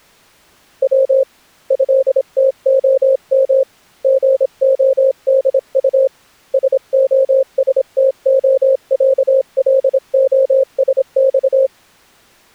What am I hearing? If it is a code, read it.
Morse code (Russian alphabet), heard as a keyed tone, hand-sent with a paddle, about 26 wpm, 530 Hz. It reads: В ЭТОМ ГОДУ СОСТОЯЛОСЬ